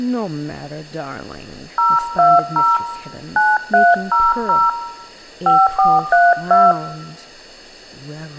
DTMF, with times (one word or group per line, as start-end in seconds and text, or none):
1.8-2.8 020
3.4-4.7 9300
5.5-6.7 5432